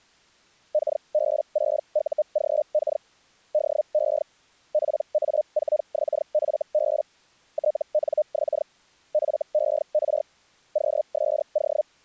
Hellschreiber (Feld-Hell, 122.5 baud), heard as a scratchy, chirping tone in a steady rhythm, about 610 Hz. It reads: KB6UGK DE PA4XFB TNX FER QSO